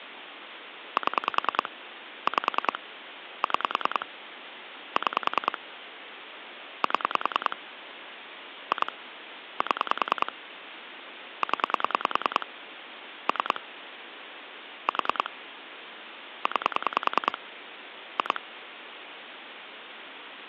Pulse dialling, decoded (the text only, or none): 7 5 6 6 7 2 7 0 3 4 9 2